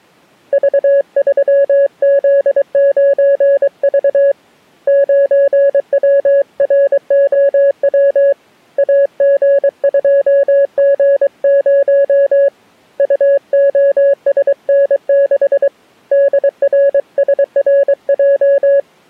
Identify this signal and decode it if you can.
Morse code, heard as a keyed tone, hand-sent with a paddle, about 23 wpm, 560 Hz. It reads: V3Z9V 9WROW AG2G0 UOSN6 DRSRJ